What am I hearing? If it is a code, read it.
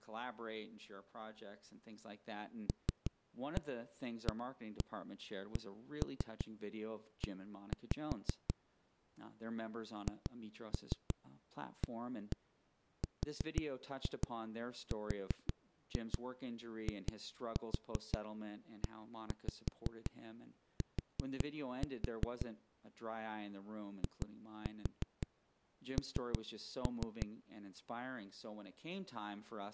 Tap code, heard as knocks on a wall, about 5 knocks a second, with speech in English. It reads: LAKE HARRIET IN